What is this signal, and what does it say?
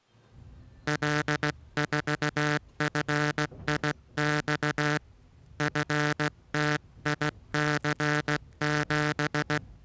Morse code, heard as a buzzer, hand-sent with a straight key, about 16 wpm, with the noise inside a bus. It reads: L4FIX FTIC7